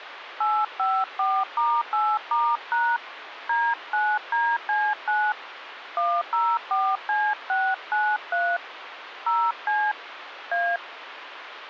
DTMF, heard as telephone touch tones, dialled by hand, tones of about 240 ms, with phone line noise. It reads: 854*8*# D9DC9 104C693 0C A